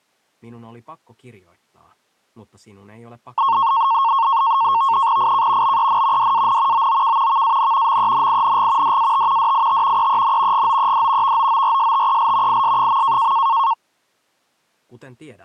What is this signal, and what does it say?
NAVTEX (SITOR-B), 100 baud, 170 Hz shift, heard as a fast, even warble, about 1000 Hz centre. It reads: IK BEN DAN OOK VAN MENING DAT DIT EEN GOED VOORSTEL IS.